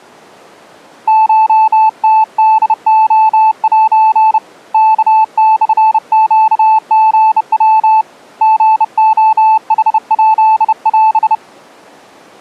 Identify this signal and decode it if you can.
Morse code (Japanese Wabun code), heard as a keyed tone, hand-sent with a bug key, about 30 wpm, 880 Hz. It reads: コムホレセ ワモネリヤ リレヌヱオ